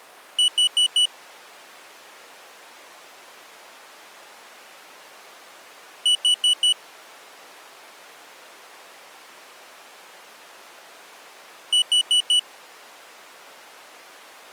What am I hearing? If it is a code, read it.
Alarm pattern, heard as an alarm's beeps, played three times, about 2950 Hz. Temporal four. Carbon monoxide.